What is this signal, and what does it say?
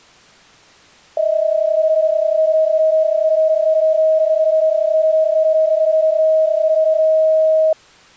PSK31 (31.25 baud), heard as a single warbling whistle, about 630 Hz.